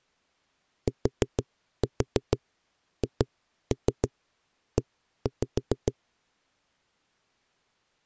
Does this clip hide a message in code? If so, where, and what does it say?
Yes: tap code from 0.9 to 5.9 s, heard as knocks on a wall, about 6 knocks a second. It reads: THE